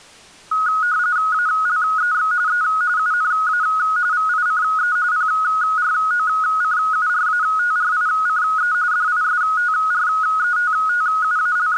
RTTY (45.45 baud, 170 Hz shift), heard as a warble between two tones, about 1360 Hz centre. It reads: ALEX E UNA VICE PROCURATRICE …